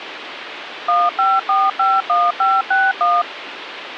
DTMF, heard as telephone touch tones, dialled by machine, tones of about 210 ms, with phone line noise. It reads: 15451561